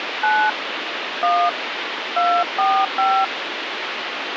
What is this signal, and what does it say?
DTMF, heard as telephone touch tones, dialled by hand, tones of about 260 ms, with phone line noise. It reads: 9 1 245